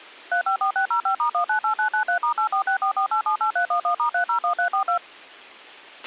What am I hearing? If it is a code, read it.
DTMF, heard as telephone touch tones, dialled by machine, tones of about 100 ms, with a squelch burst at the end. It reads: 354605*198993*84644878311*301342